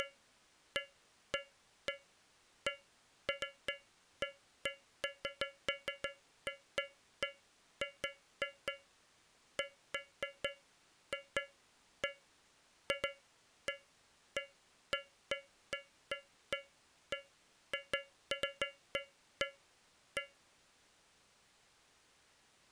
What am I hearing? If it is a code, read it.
Irregular taps on a metal pipe. There is no code.